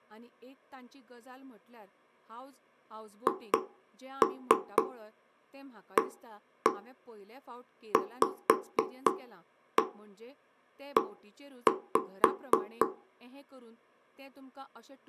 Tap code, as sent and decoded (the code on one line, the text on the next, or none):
2-3 1-1 5-1 1-5
HAVE